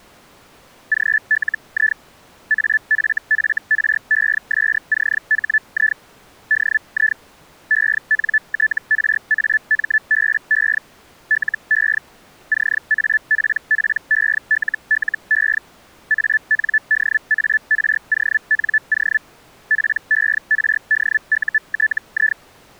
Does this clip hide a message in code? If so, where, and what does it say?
Yes: Hellschreiber (Feld-Hell, 122.5 baud) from 0.9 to 22.4 s, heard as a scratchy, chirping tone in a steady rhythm, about 1750 Hz. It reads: GLI AFFRESCHI DI ENTRAMBE LE CAPPELLE ANDARONO PERDUTI